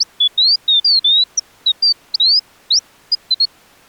Bird-like chirps. There is no code.